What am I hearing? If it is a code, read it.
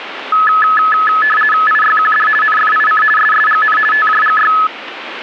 RTTY (50 baud, 450 Hz shift), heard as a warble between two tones, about 1500 Hz centre, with radio static. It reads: IYQD NFIC SSGN TJGY